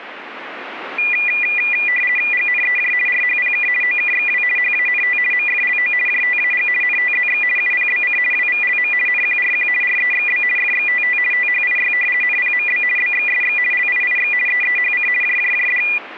RTTY (50 baud, 450 Hz shift), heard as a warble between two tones, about 2200 Hz centre. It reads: GNEJ RHPK OKXW HANT MFLO JTAG NTZX UPBC WVLM NQRQ REXB FXTT THIY NPMB BXSX LIIX EEHC JJJD